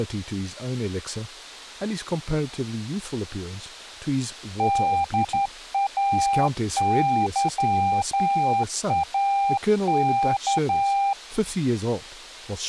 Morse code, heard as a keyed tone, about 11 wpm, 800 Hz, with speech in English. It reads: DAYAK